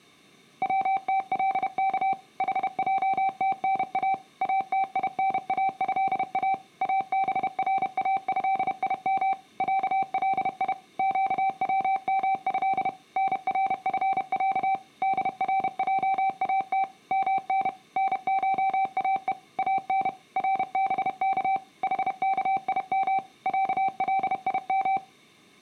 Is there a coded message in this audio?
Yes: Morse code (Arabic alphabet) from 0.6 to 25.0 s, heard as a keyed tone, machine-sent, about 31 wpm, 770 Hz. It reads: وتلك حجتنا اتيناها ابراهيم علي قومه نرفع درجات من نشاء ان ربك حكيم عليم